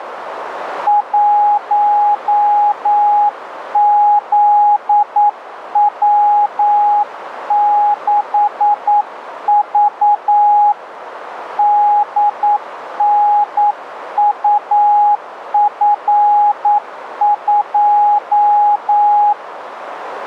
Morse code, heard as a keyed tone, hand-sent with a paddle, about 9 wpm, 830 Hz, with radio static and a narrow filter. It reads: 1ZW6V DNUF2